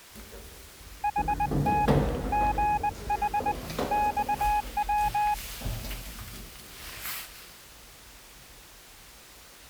Morse code, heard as a keyed tone, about 20 wpm, 840 Hz, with the noise inside a lift. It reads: HT GH XW